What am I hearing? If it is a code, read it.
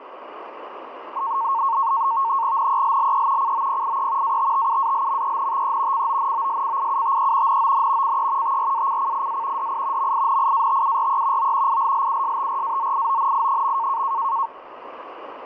NAVTEX (SITOR-B), 100 baud, 170 Hz shift, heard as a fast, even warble, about 1000 Hz centre, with radio static. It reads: NELLE COPIE ATTUALMENTE CONOSCIUTE NON CE TRACCIA DI MINIATURE O ILLUSTRAZIONI.